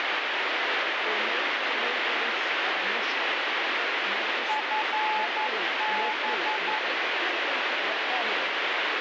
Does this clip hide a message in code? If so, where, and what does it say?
Yes: Morse code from 4.4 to 6.8 s, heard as a keyed tone, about 11 wpm, 860 Hz, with heavy radio static and speech in English. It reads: FB